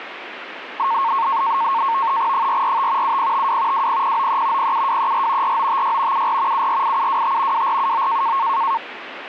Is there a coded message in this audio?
Yes: NAVTEX (SITOR-B), 100 baud, 170 Hz shift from 0.8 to 8.8 s, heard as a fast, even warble, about 1000 Hz centre, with radio static. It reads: 445 7052 20093 07234 4956 74 748725 2479